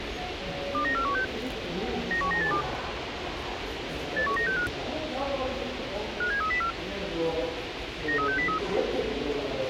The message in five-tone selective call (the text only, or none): 29416 91982 81965 57304 93603